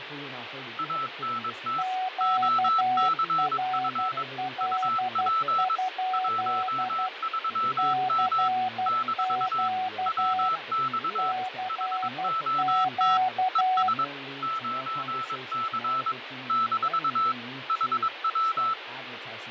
Morse code, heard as two keyed tones, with radio static, fading and speech in English. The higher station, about 22 wpm, 1320 Hz: ANT OCF UP 13M - WX HOT ES 9C - HW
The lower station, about 12 wpm, 750 Hz: QRL? CQ CQ